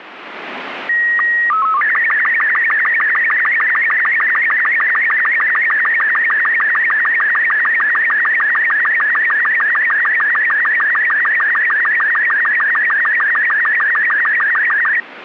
SSTV (slow-scan television), Robot 36, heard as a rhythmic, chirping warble, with radio static.